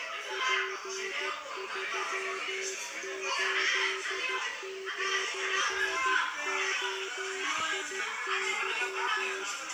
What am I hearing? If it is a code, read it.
Morse code, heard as a keyed tone, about 13 wpm, 380 Hz, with the noise of a crowd indoors. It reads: P389OIY